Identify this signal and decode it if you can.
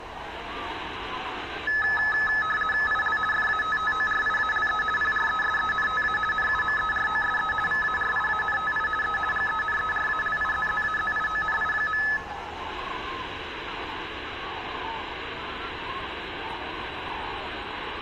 RTTY (50 baud, 450 Hz shift), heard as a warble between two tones, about 1500 Hz centre, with room echo. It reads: IL FATTORIALE PRESENTA NUMEROSE VARIANTI E GENERALIZZAZIONI.